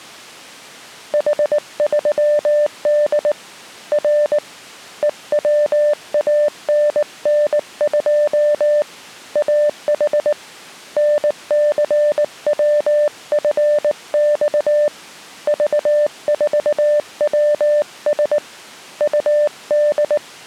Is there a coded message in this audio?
Yes: Morse code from 1.1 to 20.2 s, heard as a keyed tone, hand-sent with a paddle, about 19 wpm, 590 Hz. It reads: H3D R EWANN2 AH NCWFX V4WS UD